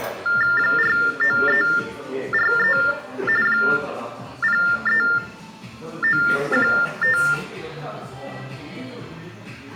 TTY/TDD text telephone tones (45.45 baud Baudot), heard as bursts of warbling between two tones, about 400 Hz shift, 1600 Hz centre, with room echo and the noise of a crowd indoors. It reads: 49343 03915